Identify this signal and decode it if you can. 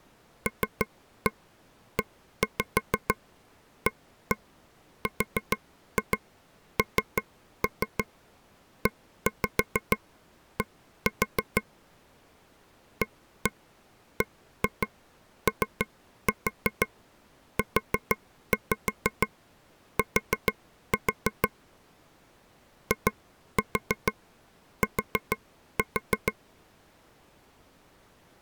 Tap code, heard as taps on a table, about 6 knocks a second. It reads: LEARNED ABOUT IT